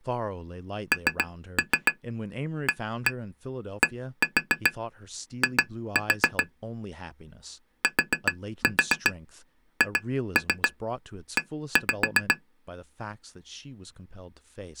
Tap code, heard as taps on glass, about 7 knocks a second, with speech in English. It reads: NADI THE